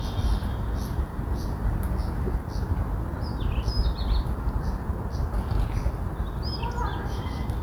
The noise of a park. There is no code.